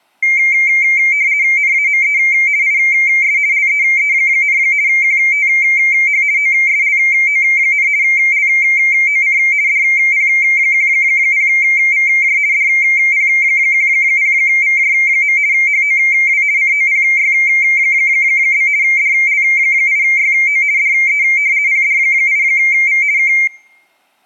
RTTY (50 baud, 170 Hz shift), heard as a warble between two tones, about 2200 Hz centre. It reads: NAME IS LEE, QTH OSLO, LOC DP10VJ DP10VJ. HOW COPY? DL8YO DE PD8V K